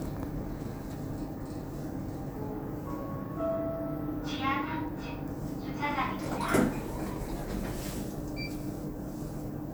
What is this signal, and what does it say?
The noise inside a lift. There is no code.